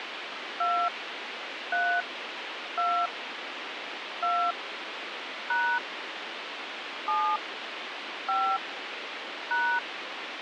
DTMF, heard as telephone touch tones, dialled by hand, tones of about 280 ms, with radio hiss. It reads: 2 3 2 2 # 7 5 #